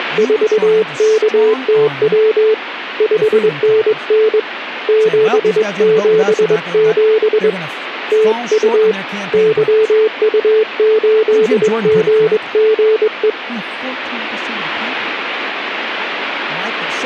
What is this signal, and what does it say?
Morse code, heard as a keyed tone, hand-sent with a straight key, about 22 wpm, 440 Hz, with radio static and speech in English. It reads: … 5NN 777 TU YU8GGE